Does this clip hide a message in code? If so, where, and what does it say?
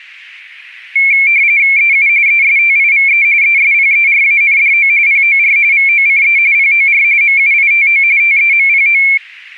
Yes: RTTY (45.45 baud, 170 Hz shift) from 1.0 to 9.2 s, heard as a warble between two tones, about 2250 Hz centre. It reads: EU ESTIVE ESPERANDO POR VOCE POR MUITO TEMPO